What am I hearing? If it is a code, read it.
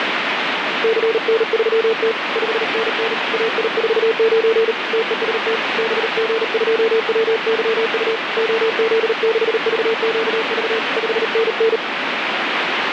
Morse code, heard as a keyed tone, hand-sent with a paddle, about 38 wpm, 450 Hz, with heavy radio static. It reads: CN3T 5NN AI49 TEST BG2WYU OZ6VQV 5NN